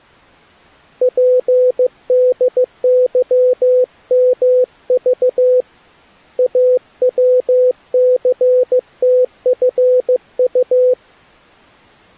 Morse code, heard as a keyed tone, hand-sent with a paddle, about 15 wpm, 500 Hz. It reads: PDYMV AWCTFU